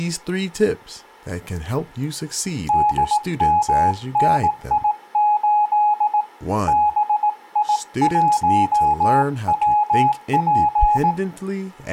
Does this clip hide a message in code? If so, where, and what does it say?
Yes: Morse code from 2.6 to 11.2 s, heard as a keyed tone, hand-sent with a paddle, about 18 wpm, 840 Hz, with room echo and speech in English. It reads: DMNI8 BI1WP